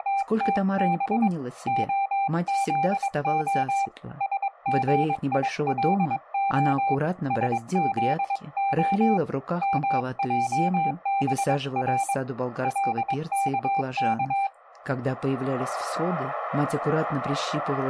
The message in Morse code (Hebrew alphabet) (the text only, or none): … הזה שגילה שזה מעבר לכך